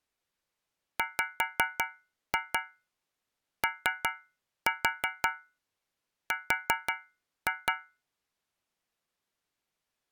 Tap code, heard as taps on a metal pipe, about 5 knocks a second. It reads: WOR